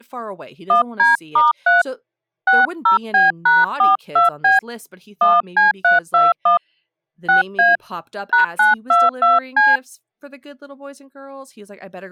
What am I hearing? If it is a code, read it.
DTMF, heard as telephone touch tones, dialled by hand, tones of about 160 ms, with speech in English. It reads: 1D*3 60B#42B 1C321 6A #922C